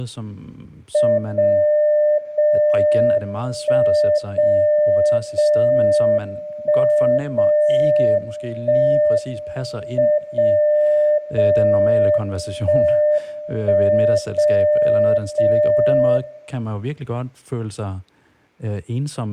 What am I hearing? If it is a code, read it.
Radio time signal (WWVB), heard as a tone whose level steps once a second, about 600 Hz, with room echo and speech in Danish. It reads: 0 0 1 0 0 1 0 1 M 0 0 1 1 0 0